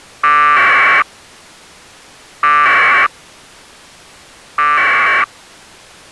Packet radio (AX.25, as in APRS), 1200 baud, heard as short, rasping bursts.